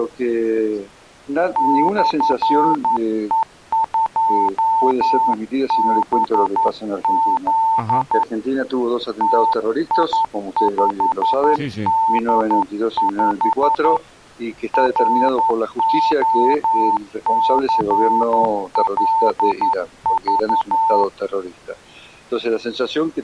Morse code, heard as a keyed tone, hand-sent with a paddle, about 11 wpm, 900 Hz. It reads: /E2BZ TI5D5 ROCLV